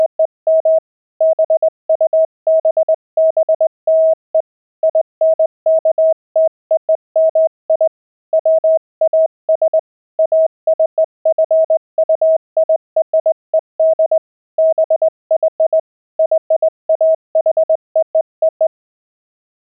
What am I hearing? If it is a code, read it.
Morse code (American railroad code), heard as a keyed tone, hand-sent with a straight key, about 640 Hz. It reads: … BUBBLE INKTOMI WAS ACQUIRED BY YAHOO